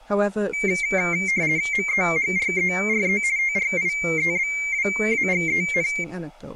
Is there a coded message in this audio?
Yes: RTTY (50 baud, 170 Hz shift) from 0.5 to 6.0 s, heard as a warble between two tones, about 2200 Hz centre, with speech in English. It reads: MEHRERE TRIEBWAGEN